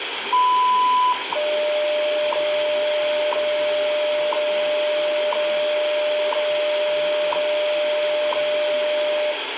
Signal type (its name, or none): radio time signal